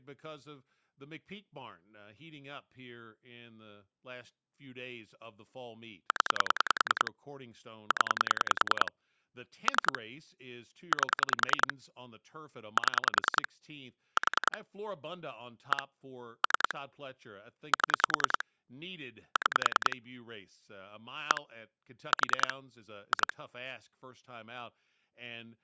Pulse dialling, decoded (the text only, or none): 0 0 3 8 7 4 1 3 7 6 1 4 2